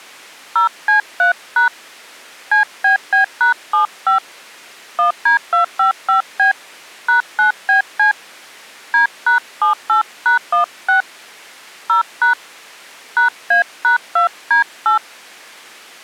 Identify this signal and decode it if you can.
DTMF, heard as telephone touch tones, dialled by hand, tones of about 120 ms. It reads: 0C3# CBB#75 1D255B #9BC D#78#16 0# #A#2D8